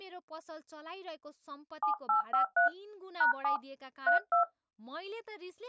DTMF, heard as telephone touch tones, dialled by hand, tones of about 120 ms, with speech in Nepali. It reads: 7853 #7 32